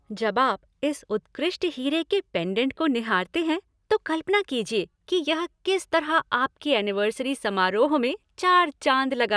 Speech in Hindi. There is no code.